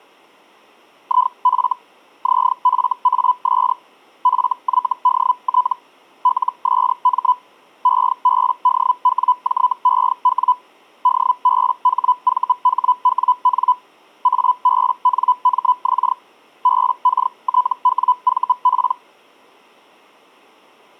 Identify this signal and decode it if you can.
Hellschreiber (Feld-Hell, 122.5 baud), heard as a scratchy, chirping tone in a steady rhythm, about 1000 Hz. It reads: IF ZFAS FYDT LSM EBDWJEW DBHVHWN ABNMX BKTWVP